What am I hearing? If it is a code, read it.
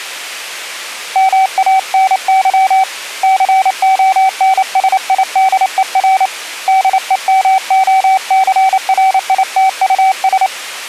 Morse code, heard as a keyed tone, hand-sent with a paddle, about 28 wpm, 760 Hz. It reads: MANY CONSIDER DEMOCRITUS